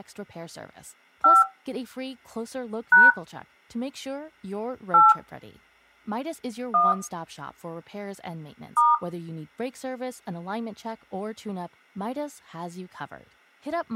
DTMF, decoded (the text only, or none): 5 # 8 1 *